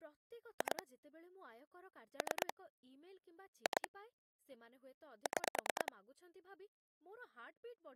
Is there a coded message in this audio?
Yes: pulse dialling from 0.6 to 5.9 s, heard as clicks on a phone line, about 9 pulses a second, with speech in Odia. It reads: 2 3 2 6